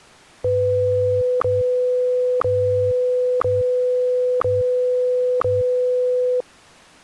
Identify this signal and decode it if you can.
Radio time signal (WWVH, Hawaii), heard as ticks, one a second.